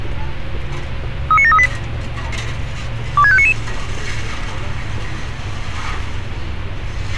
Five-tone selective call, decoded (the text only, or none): 39738 26599